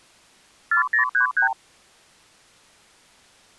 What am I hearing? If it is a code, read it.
Multi-frequency trunk signalling (R2, with the far end's replies), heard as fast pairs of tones, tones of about 110 ms. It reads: 4033